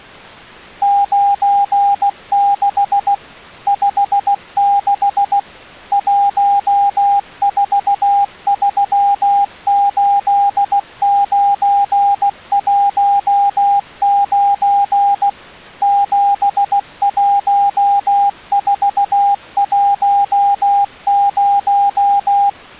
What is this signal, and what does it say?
Morse code, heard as a keyed tone, machine-sent, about 16 wpm, 800 Hz. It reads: 96 56 1438919 71410